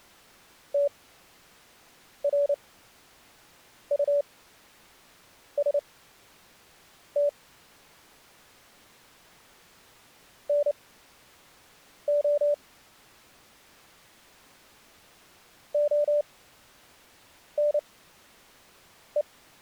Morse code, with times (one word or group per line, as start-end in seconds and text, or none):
0.7-7.3 TRUST
10.5-12.5 NO
15.7-19.2 ONE